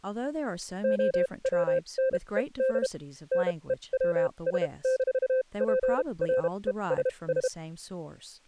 Morse code, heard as a keyed tone, machine-sent, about 32 wpm, spaced as for 25 wpm, 520 Hz, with speech in English. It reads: OWNED NEWS-PRESS